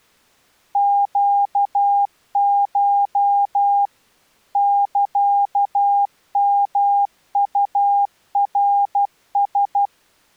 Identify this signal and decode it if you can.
Morse code (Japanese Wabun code), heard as a keyed tone, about 12 wpm, 810 Hz. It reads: ネコ サヨウナラ